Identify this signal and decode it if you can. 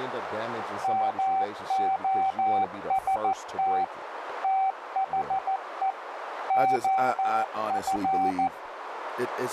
Morse code, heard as a keyed tone, machine-sent, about 14 wpm, 770 Hz, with radio static, a narrow filter and speech in English. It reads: MOST THE OF